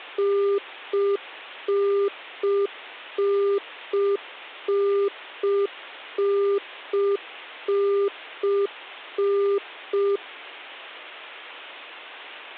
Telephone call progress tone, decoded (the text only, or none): congestion tone